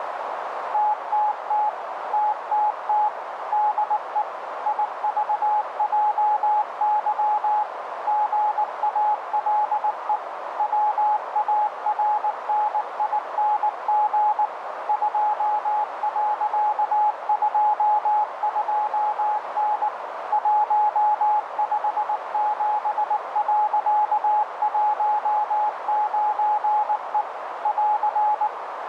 Morse code, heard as a keyed tone, machine-sent, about 19 wpm, 840 Hz, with radio static and a narrow filter. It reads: TTT TTT DE IVJY GALE WARNING 2.22N 157.19E <AR>